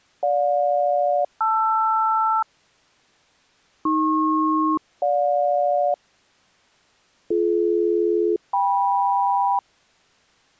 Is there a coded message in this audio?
Yes: aircraft SELCAL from 0.2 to 9.6 s, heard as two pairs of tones. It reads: GJ-LR AP-GJ BD-KM